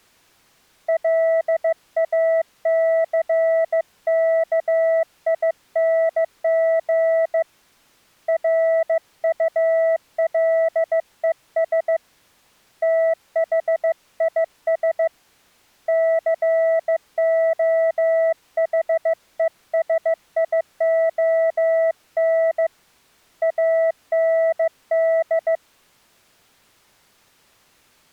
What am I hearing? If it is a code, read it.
Morse code, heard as a keyed tone, hand-sent with a bug key, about 15 wpm, 650 Hz. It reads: LACKING RULES THIS COHESION AND